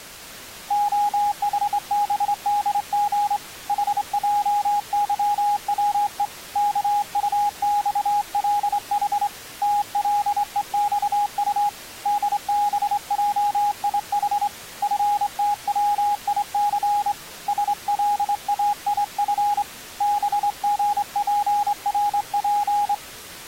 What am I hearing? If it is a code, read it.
Morse code, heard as a keyed tone, hand-sent with a straight key, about 25 wpm, 820 Hz. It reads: OHBDG HJYWE KUXLH TLEXU DBJIH FTWIC SLAIF BGPRP